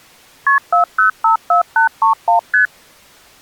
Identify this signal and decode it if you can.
Multi-frequency trunk signalling (R1, as on North American trunks), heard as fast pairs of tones, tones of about 120 ms. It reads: KP 4054831 ST